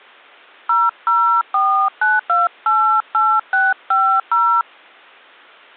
DTMF, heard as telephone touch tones, dialled by hand, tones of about 250 ms. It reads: 0049288650